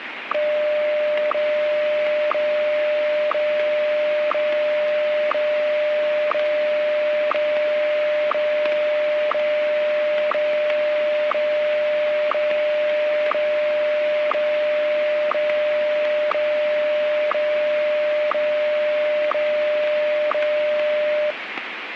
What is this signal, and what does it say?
Radio time signal (WWVH, Hawaii), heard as ticks, one a second, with radio static.